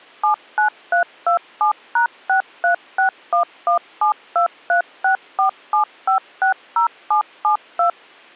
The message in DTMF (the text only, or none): 79327#63611723647560772